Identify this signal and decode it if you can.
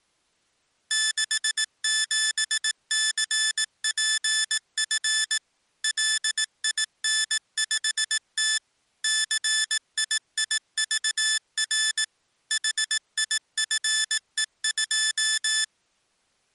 Morse code, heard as electronic beeps, machine-sent, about 18 wpm, 1750 Hz. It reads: 67CPF LIN5T CIIVR HIFE2